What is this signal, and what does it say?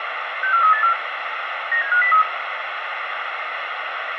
Five-tone selective call (CCIR), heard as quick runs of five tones, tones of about 100 ms, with radio hiss. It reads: 64384 97503